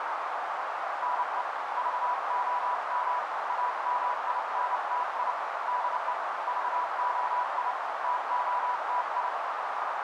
Morse code, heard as a keyed tone, hand-sent with a paddle, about 29 wpm, 980 Hz, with heavy radio static and a narrow filter. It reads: NE VOM AMINTI DE VOI TOTI